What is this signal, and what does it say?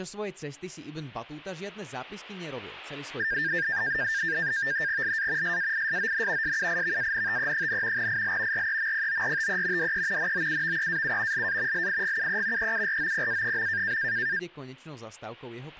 NAVTEX (SITOR-B), 100 baud, 170 Hz shift, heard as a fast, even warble, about 1700 Hz centre, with speech in Slovak. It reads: LA SAISON SUIVANTE, IL REMPORTE DE NOUVEAU LA LIGUE EUROPA.